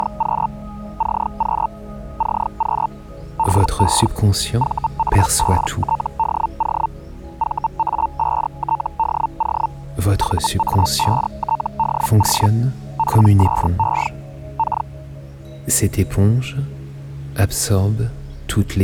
Hellschreiber (Feld-Hell, 122.5 baud), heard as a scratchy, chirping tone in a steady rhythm, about 900 Hz. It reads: … CQ CQ DE VA5TDO VA5TDO VA5TDO PSE K